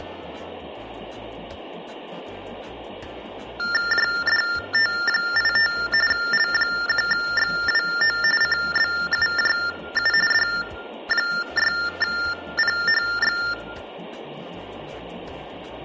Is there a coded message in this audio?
Yes: TTY/TDD text telephone tones (45.45 baud Baudot) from 3.6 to 13.5 s, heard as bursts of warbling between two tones, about 400 Hz shift, 1600 Hz centre. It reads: JDT85 L1XWO CBUJU D6PHX